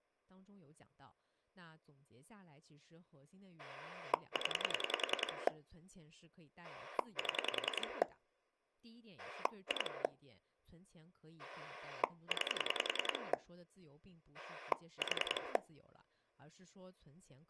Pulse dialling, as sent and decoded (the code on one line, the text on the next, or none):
10 / 7 / 2 / 9 / 4
0 7 2 9 4